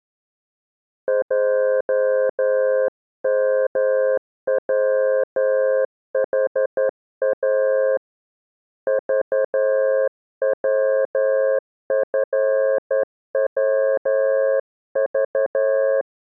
Morse code, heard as a keyed tone, hand-sent with a straight key, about 11 wpm, 530 Hz. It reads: JMWHA VWFWV